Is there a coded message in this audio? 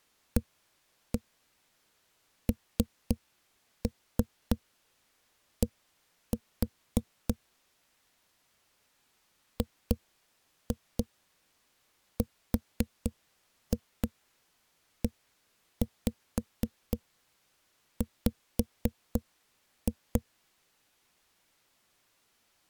Yes: tap code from 0.4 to 20.2 s, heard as knocks on a wall, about 3 knocks a second. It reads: AND GREW